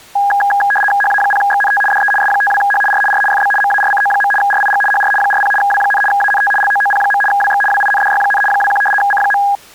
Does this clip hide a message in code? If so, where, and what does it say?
Yes: RTTY (75 baud, 850 Hz shift) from 0.2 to 9.6 s, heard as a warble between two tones, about 1230 Hz centre. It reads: HA0XNT DE S52H R R FB MARCO. RIG HR 40 W, ANT LOOP. WX WINDY, 21 C.